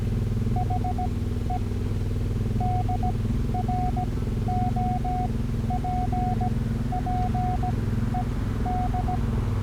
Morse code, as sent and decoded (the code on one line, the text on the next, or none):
.... . / -.. .-. --- .--. .--. . -..
HE DROPPED